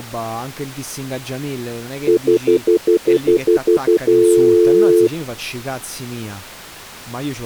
Telephone call progress tone (North American plan), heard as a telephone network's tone, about 350, 440 Hz, 0.1 s on and 0.1 s off, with speech in Italian. Stutter dial tone.